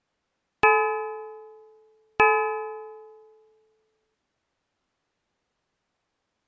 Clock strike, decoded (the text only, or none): 2